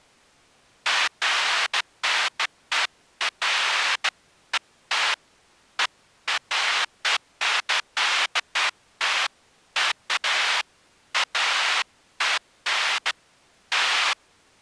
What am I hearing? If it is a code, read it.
Bursts of noise. There is no code.